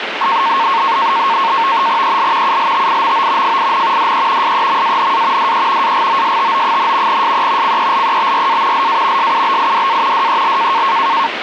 NAVTEX (SITOR-B), 100 baud, 170 Hz shift, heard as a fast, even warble, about 1000 Hz centre, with radio static. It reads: EL ULTIMO FIN DE SEMANA DE AGOSTO, SE CELEBRA LA SUBIDA DEL